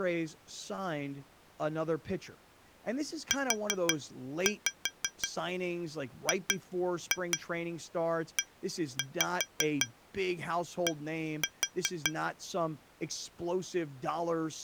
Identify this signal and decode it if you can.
Tap code, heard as taps on glass, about 5 knocks a second, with speech in English. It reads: UGED